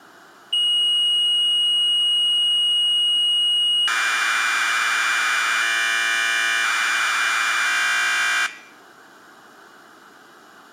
Commodore tape loading (standard loader), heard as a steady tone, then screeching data.